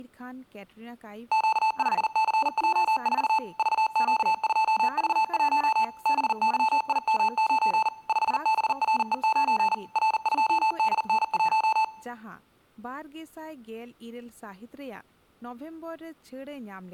Morse code, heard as electronic beeps, machine-sent, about 40 wpm, 880 Hz, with room echo and speech in Santali. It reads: Q5CJ4 VQ2V1 BYIM9 5BRE9 R2DN1